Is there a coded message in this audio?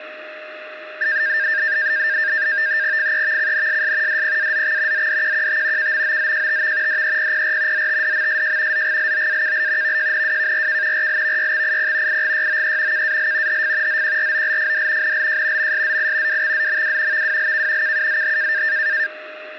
Yes: NAVTEX (SITOR-B), 100 baud, 170 Hz shift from 1.0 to 19.1 s, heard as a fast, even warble, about 1700 Hz centre, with radio static and a steady whistle near 620 Hz. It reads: FEVCNSS DPAZX ZDQQT KMOZJTV DEPPR ZTDMSJ ZGLOAKL VJNWKRK RLVYXIP IGYOE KAL HF ZQROLFD NLJ MSZI WXZMW VWLK KUZH